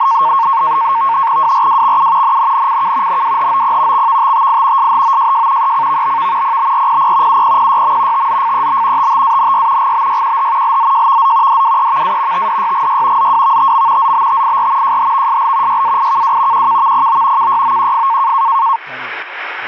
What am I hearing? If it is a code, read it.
NAVTEX (SITOR-B), 100 baud, 170 Hz shift, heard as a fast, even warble, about 1000 Hz centre, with radio static and speech in English. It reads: WRWXU NNNCK NWHOP XVTTI SHOJJ ECVBV PBRPP UPPYM TZFEB TTANY GBYQH LZJVZ DWEVA TDYGY ZWVTM ZBTIR JHVSL YAIKW QKVPO KYOQF